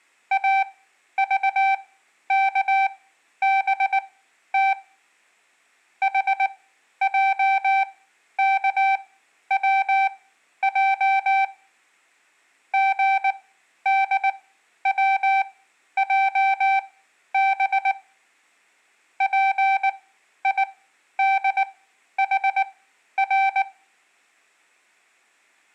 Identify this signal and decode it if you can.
Morse code, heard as a keyed tone, machine-sent, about 19 wpm, spaced as for 11 wpm, 780 Hz. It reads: AVKBT HJKWJ GDWJB PIDHR